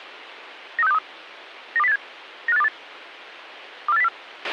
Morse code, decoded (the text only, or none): none